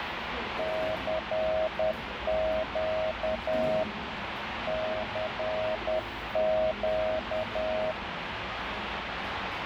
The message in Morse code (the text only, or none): CQ CQ